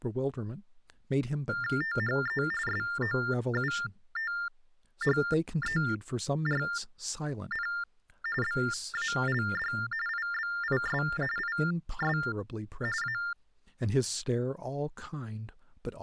TTY/TDD text telephone tones (45.45 baud Baudot), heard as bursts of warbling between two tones, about 400 Hz shift, 1600 Hz centre, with speech in English. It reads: THE SOUTHERN BALD IBIS IS A